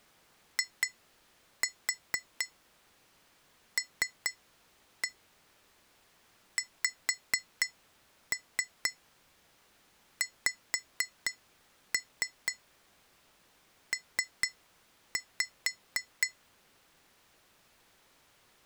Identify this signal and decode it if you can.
Tap code, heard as taps on glass, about 4 knocks a second. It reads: ILXXP